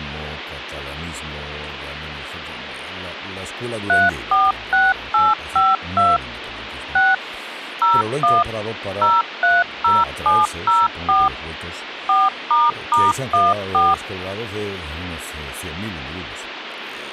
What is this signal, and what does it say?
DTMF, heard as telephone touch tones, dialled by machine, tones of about 200 ms, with phone line noise. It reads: 346852 6 01 030704 4**14